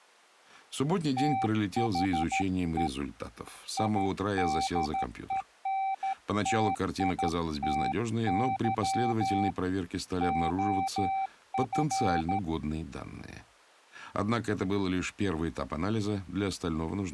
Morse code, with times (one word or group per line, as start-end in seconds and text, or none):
1.2-2.9 THE
3.8-9.5 IDENTITY
10.2-12.4 OF